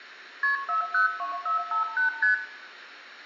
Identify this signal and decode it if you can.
Multi-frequency trunk signalling (R1, as on North American trunks), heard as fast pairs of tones, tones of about 120 ms, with room echo. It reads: KP 402458 ST